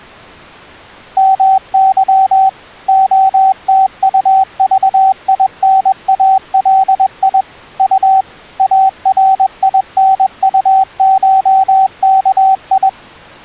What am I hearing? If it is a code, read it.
Morse code (Russian alphabet), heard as a keyed tone, machine-sent, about 21 wpm, 770 Hz. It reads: МЫ ОТУЖИНАЛИ У АРИНУШКИ